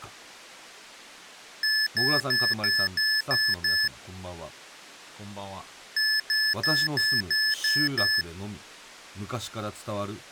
Beep code, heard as beeps from a small speaker, played twice, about 1750 Hz, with speech in Japanese. 7 short. In AMI BIOS tables: virtual mode exception error; in Dell tables: processor failure.